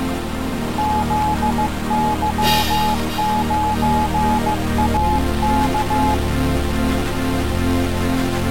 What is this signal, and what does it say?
Morse code, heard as a keyed tone, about 15 wpm, 850 Hz. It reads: ZY9AK